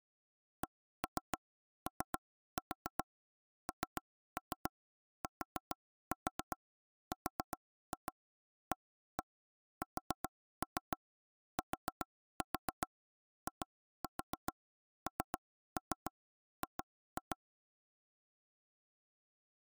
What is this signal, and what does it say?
Tap code, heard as taps on a table, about 7 knocks a second. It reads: CONTRASTING